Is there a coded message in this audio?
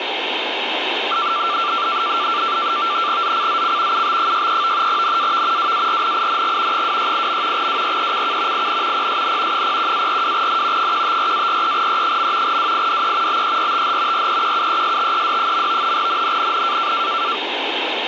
Yes: NAVTEX (SITOR-B), 100 baud, 170 Hz shift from 1.1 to 17.3 s, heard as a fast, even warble, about 1270 Hz centre, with radio static. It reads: ZCZC UB63 NAV WARNING 268. WRECK IN PSN 01-42N 154-43E. WIDE BERTH REQUESTED. NNNN